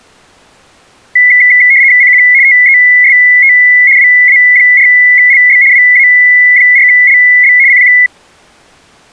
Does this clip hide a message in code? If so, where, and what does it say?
Yes: RTTY (75 baud, 170 Hz shift) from 1.2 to 8.1 s, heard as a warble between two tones, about 2050 Hz centre. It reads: CQ TEST WA4LB WA4LB CQ